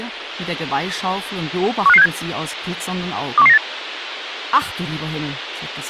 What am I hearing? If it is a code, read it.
Five-tone selective call (EEA), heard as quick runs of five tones, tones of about 40 ms, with radio hiss. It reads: 15567 21198